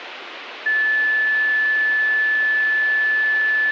A steady tone, with radio hiss. There is no code.